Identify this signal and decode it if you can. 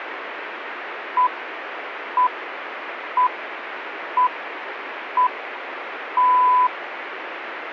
Radio time signal (six pips, as the Greenwich Time Signal), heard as pips, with radio static.